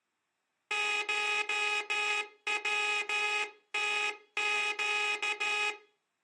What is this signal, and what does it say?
Morse code (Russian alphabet), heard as a buzzer, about 13 wpm. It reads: ШВТЩ